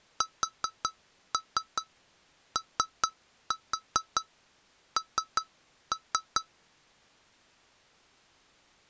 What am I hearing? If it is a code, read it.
Tap code, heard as taps on glass, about 4 knocks a second. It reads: SON